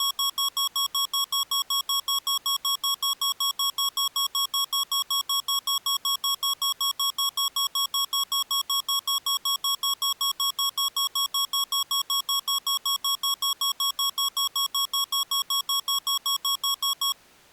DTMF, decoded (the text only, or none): none